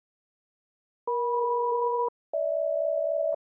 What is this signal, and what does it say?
Aircraft SELCAL, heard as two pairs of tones. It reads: EM-GH